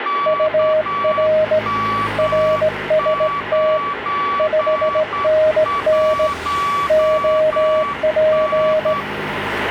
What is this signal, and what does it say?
Morse code, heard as two keyed tones, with radio static and street noise. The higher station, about 9 wpm, 1140 Hz: KM91N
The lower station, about 17 wpm, 620 Hz: UR RST 5NN OP